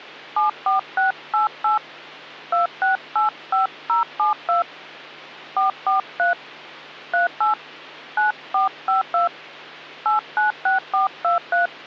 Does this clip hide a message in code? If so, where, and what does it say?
Yes: DTMF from 0.4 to 11.7 s, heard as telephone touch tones, dialled by hand, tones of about 140 ms, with hum. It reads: 74688 2685072 443 38 9452 896423